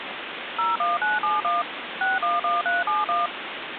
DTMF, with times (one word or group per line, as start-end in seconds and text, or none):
0.6-1.6 01971
2.0-3.3 611371